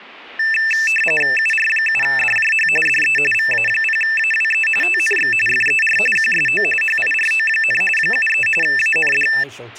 RTTY (45.45 baud, 850 Hz shift), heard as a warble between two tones, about 2200 Hz centre, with speech in English. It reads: UR7DJH DE VA0AWE TNX FER QSO HIRO, 73 AND